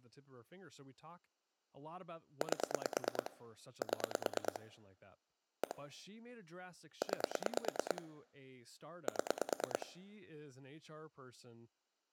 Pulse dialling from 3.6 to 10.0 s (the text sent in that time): 7 1 9 7